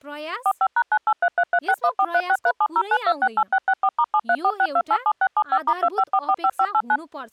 DTMF, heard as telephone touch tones, dialled by machine, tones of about 60 ms, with speech in Nepali. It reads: 45#98333614363709268664*7346287675*25445589